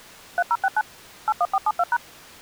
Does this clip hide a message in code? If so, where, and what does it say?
Yes: DTMF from 0.4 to 2.0 s, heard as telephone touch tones, dialled by machine, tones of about 50 ms. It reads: 3069 81472#